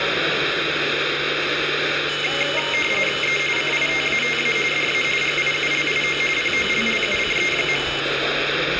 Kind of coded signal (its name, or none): RTTY